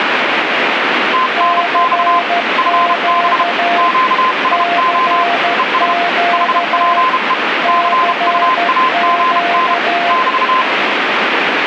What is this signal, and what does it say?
Morse code, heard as two keyed tones, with radio static. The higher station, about 32 wpm, 1030 Hz: TNX FB QSO ES HPE CUAGN <BT>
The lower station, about 13 wpm, 690 Hz: CQ CQ CQ